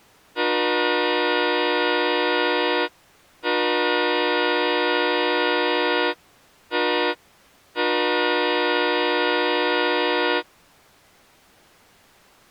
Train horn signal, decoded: 2 long, 1 short, 1 long

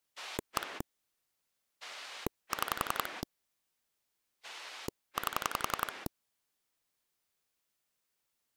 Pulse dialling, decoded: 1 6 8

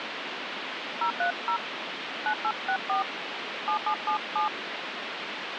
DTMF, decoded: 030 9864 7777

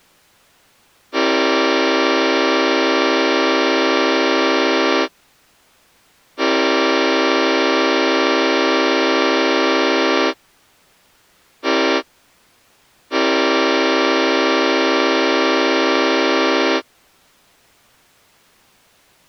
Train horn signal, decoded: 2 long, 1 short, 1 long

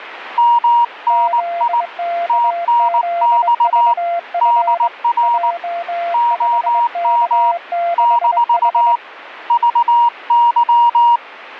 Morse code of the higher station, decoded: MNI TNX DR OM - VY

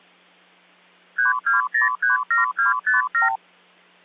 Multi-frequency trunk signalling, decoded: 32037257

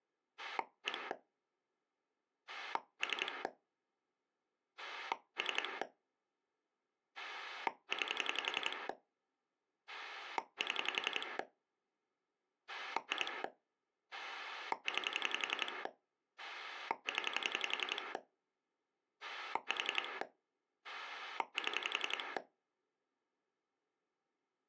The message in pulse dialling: 1 3 3 9 7 2 9 0 4 7

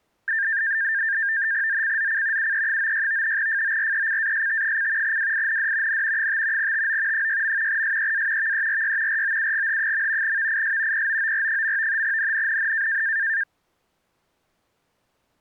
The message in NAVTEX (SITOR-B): ZCZC UE96 FORECAST: WIND N 5 TO 6. SEA VERY ROUGH. VIS POOR. NNNN

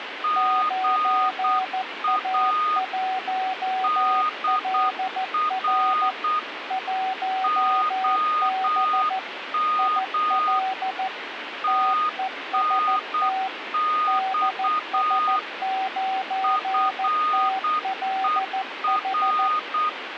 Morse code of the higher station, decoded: GA DR OM TNX FER

